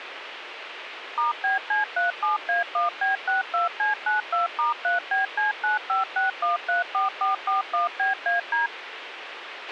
DTMF, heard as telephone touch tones, dialled by machine, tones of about 140 ms, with radio hiss and a squelch burst at the end. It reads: *BC37A1B62C92*3BC956134441BAD